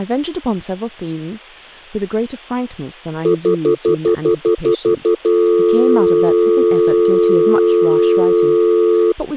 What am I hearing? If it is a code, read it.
Telephone call progress tone (North American plan), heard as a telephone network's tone, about 350, 440 Hz, 0.1 s on and 0.1 s off, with speech in English. Stutter dial tone.